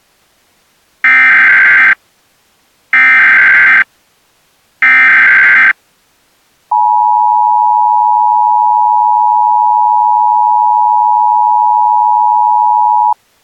Emergency Alert System (SAME) tones (header bursts, then the 853 and 960 Hz attention tone), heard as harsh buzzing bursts, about 520.83 baud.